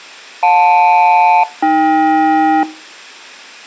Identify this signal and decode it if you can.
Aircraft SELCAL, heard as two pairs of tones. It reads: JL-AK